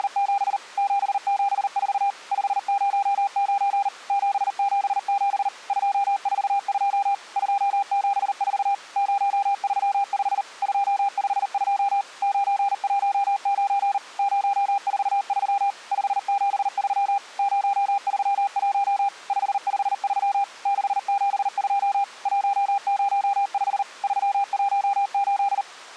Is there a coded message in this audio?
Yes: Morse code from 0.0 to 25.7 s, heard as a keyed tone, machine-sent, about 39 wpm, 800 Hz. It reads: … 774 509 777 242 274 035 252 919 043 573 031 553 672 105 318